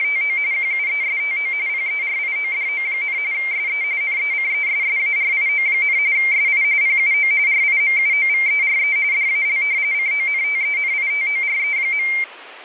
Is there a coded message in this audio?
Yes: RTTY (45.45 baud, 170 Hz shift) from 0.0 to 12.2 s, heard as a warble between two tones, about 2200 Hz centre. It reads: … QUESTO PERIODO, SE NECESSARIO, SI PUO RIMUOVERE DAL CONTENITORE.